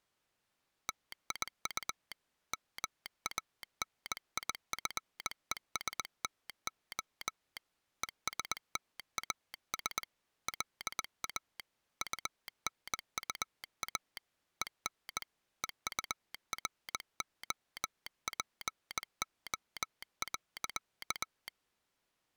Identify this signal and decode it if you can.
Morse code, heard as a telegraph sounder, hand-sent with a bug key, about 20 wpm. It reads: TIU MANIFESTO ESTAS LA UNUA EN EUROPO.